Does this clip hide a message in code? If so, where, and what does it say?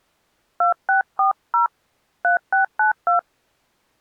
Yes: DTMF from 0.6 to 3.2 s, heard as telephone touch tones, dialled by hand, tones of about 120 ms. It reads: 2640 3692